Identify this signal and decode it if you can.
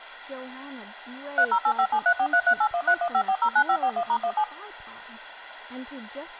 DTMF, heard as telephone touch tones, dialled by machine, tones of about 70 ms, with speech in English. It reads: 30857343381315409541*17